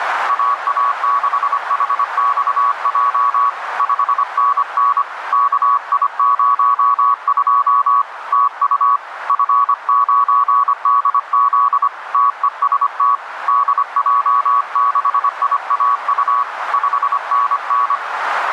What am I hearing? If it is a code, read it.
Morse code, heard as a keyed tone, hand-sent with a paddle, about 25 wpm, 1130 Hz, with radio static and a narrow filter. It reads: AA6HXJ 5NN KI02 TU F9DZ TEST DJ6IAU 5NN